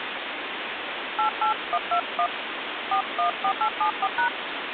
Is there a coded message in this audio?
Yes: DTMF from 1.2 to 4.3 s, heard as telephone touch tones, dialled by hand, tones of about 80 ms, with phone line noise. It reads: 88121 414874#